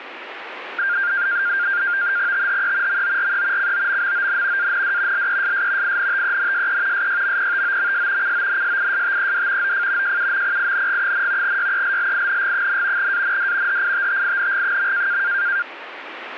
NAVTEX (SITOR-B), 100 baud, 170 Hz shift, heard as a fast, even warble, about 1500 Hz centre, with radio static. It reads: THE MORE COMMON AND LESS INTENSE SYMPTOMS CONSISTED OF JUMPING, YELLING, AND HITTING.